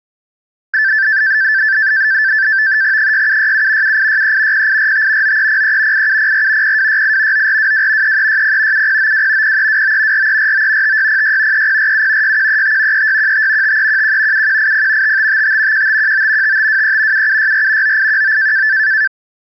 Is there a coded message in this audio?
Yes: NAVTEX (SITOR-B), 100 baud, 170 Hz shift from 0.7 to 19.1 s, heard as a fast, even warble, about 1650 Hz centre. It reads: 6767 7863 0845 9303 8704 0268 9422 3360 7092 0329 4349 5606 3047 6135 3615 5311 7180 5555 1519 5523 7764 9819